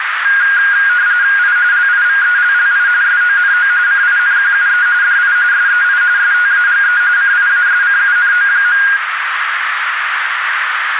RTTY (45.45 baud, 170 Hz shift), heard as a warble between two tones, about 1550 Hz centre, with radio static and a narrow filter. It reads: I LIVELLI SONO CINQUE DI SEI STAGE CIASCUNO.